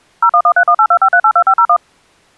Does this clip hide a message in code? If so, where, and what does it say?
Yes: DTMF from 0.2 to 1.8 s, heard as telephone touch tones, dialled by machine, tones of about 70 ms. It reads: 01131825382501